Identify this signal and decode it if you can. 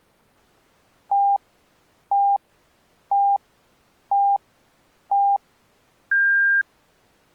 Radio time signal (five pips and a higher one, as on Chinese radio), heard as pips.